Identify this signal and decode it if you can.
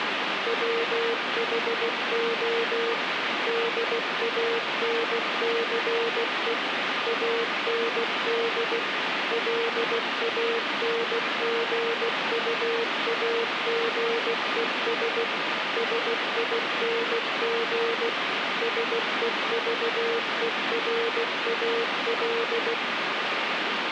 Morse code, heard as a keyed tone, machine-sent, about 16 wpm, 460 Hz, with radio static. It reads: WHO DANCE AND LANGUAGES SING SEVERAL